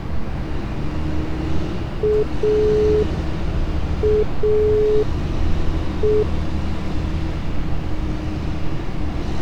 Telephone call progress tone (pulsed, as in Italy), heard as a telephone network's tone, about 420 Hz, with street noise. Dial tone.